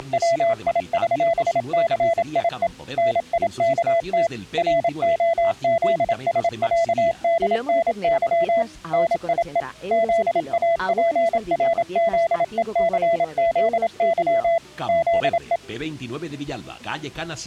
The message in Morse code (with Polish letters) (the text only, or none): … NIKT ROZSĄDNY NIE ZAPRZECZY ZE